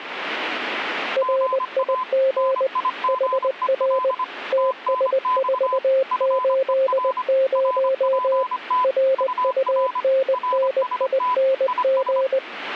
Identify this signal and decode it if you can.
Morse code, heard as two keyed tones. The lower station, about 20 wpm, 530 Hz: RIG HR TS480 RUNNING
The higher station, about 25 wpm, 1010 Hz: GA NIGEL TNX FER RPT UR RST IS